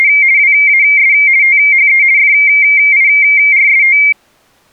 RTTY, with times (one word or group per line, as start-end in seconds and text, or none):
0.0-0.1 …
0.4-1.1 WAS
1.4-2.0 THE
2.2-4.0 FIRST